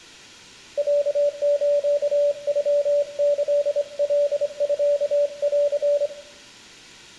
Morse code (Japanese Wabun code), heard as a keyed tone, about 25 wpm, 580 Hz, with room echo. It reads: ロスノキカミン